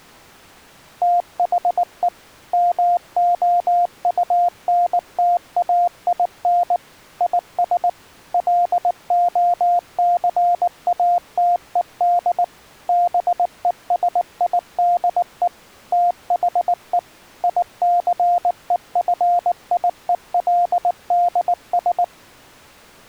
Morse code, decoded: THE MOUNTAIN IS LOCATED BESIDE THE ICEFIELDS

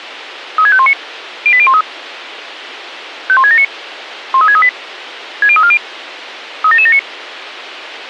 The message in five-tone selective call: 36519 08013 51679 13638 60340 37779

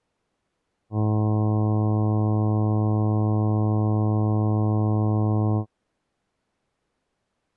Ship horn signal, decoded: 1 long

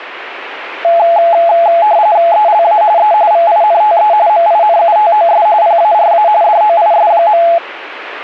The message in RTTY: ELA E VINTE MINUTOS PARA DOIS.

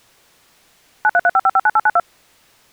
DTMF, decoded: 9335559892

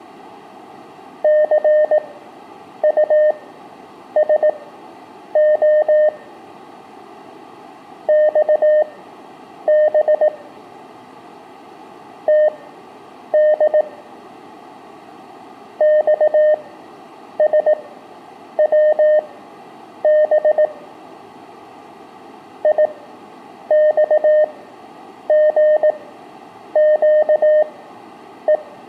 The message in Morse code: CUSO XB TD XSWB IXGQE

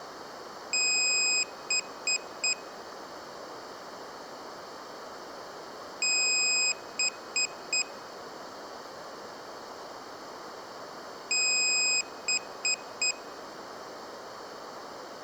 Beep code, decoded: 1 long, 3 short

